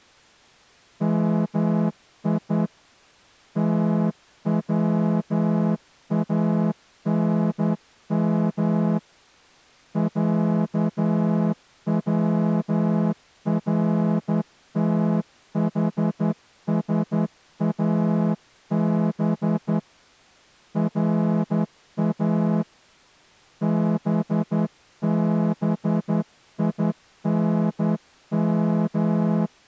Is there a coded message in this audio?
Yes: Morse code (Persian alphabet) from 1.0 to 29.5 s, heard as a horn, hand-sent with a straight key, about 11 wpm. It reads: می توانم صورتحساب را ببینم